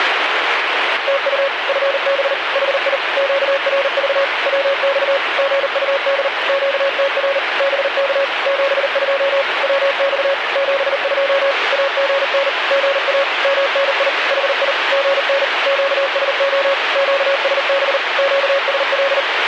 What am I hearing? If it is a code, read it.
Morse code, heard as a keyed tone, machine-sent, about 39 wpm, 550 Hz, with radio static. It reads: TU FB HI QRV WX GUD QTR BK 72 WX 72 AGN GA MNI HI GN QSO QSB QSL